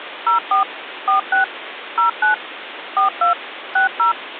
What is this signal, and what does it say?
DTMF, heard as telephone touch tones, dialled by machine, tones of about 120 ms, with phone line noise. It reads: 04 46 09 42 60